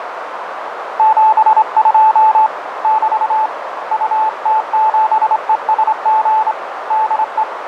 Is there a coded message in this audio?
Yes: Morse code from 0.9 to 7.5 s, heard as a keyed tone, hand-sent with a straight key, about 25 wpm, 870 Hz, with radio static and a narrow filter. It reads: 72 <BT> UT7ESG DE